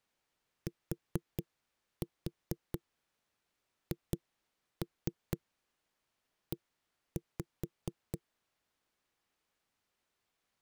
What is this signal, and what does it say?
Tap code, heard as knocks on wood, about 4 knocks a second. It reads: THE